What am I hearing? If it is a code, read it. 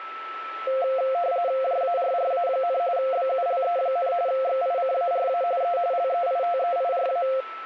RTTY (45.45 baud, 170 Hz shift), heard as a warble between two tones, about 610 Hz centre, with a steady whistle near 1320 Hz. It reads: JARRA, BULE, XICARA E LEITEIRA